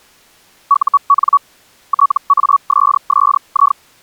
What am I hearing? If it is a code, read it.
Hellschreiber (Feld-Hell, 122.5 baud), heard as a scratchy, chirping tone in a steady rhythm, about 1130 Hz. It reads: UN TASSI